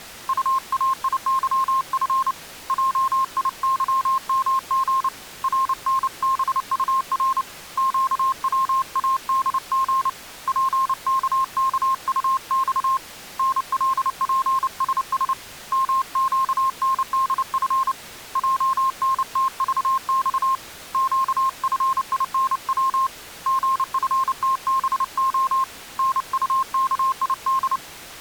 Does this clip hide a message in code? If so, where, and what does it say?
Yes: Morse code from 0.2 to 27.8 s, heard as a keyed tone, hand-sent with a paddle, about 29 wpm, 1060 Hz. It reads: UAIYF JIYMG RNBUR QWADG PKKUX NLPSS MQNDF JNTVX QFINW GFTBO NUKID